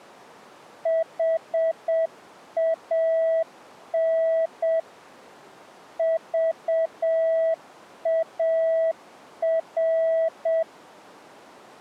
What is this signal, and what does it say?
Morse code, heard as a keyed tone, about 7 wpm, 650 Hz. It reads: HAN VAR